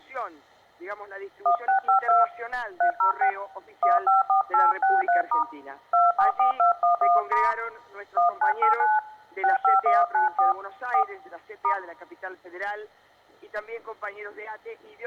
DTMF, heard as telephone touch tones, dialled by hand, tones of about 140 ms. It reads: 1652 306 154863* 244211* 1989 65194 4 *